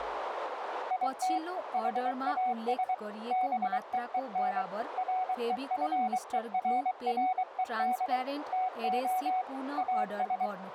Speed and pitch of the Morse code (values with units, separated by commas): 23 wpm, 740 Hz